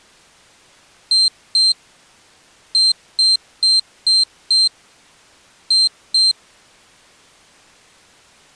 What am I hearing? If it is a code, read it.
Beep code, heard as a piezo beeper, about 4150 Hz. 2-5-2.